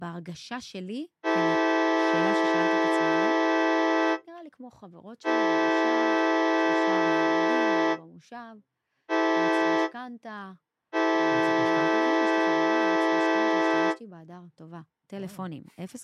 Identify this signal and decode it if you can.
Train horn signal, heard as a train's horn, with speech in Hebrew. 2 long, 1 short, 1 long. On North American railways: approaching a public crossing.